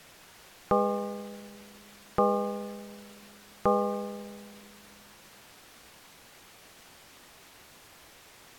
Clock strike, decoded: 3

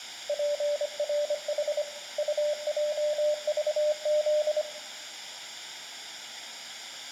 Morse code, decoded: PRH UJVZ

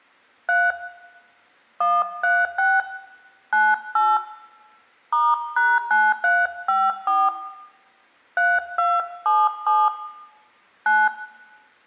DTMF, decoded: 3 136 98 *#9354 3277 9

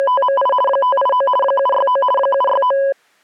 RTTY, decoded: … 589 769 769

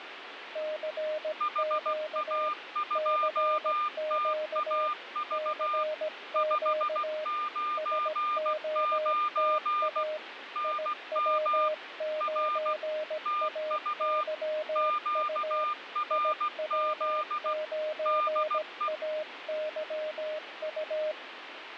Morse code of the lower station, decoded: CQ CQ CQ SOTA IW9AYU IW9AYU

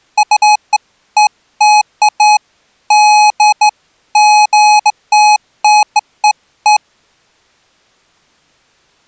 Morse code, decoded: none

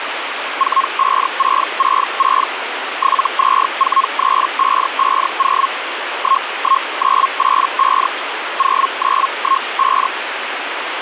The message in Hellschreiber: 45666 7243550 11985 0915

